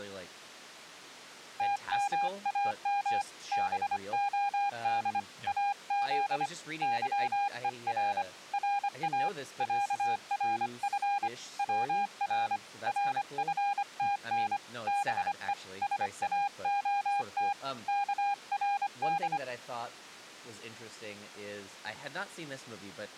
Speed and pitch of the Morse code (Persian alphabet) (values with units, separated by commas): 25 wpm, 810 Hz